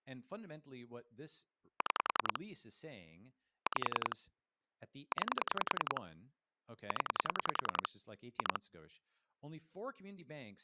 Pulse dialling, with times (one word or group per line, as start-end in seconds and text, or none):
1.8-2.4 6
3.7-4.2 5
5.1-6.0 9
6.9-7.9 0
8.4-8.6 2